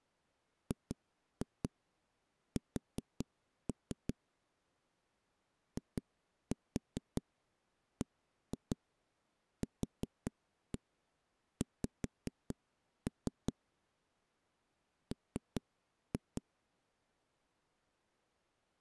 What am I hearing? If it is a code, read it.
Tap code, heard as knocks on a wall, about 5 knocks a second. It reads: GS IBQX M